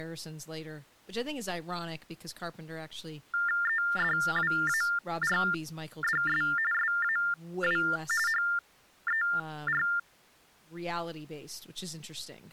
TTY/TDD text telephone tones (45.45 baud Baudot), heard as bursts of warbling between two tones, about 400 Hz shift, 1600 Hz centre, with speech in English. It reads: EDWARDS SAW HER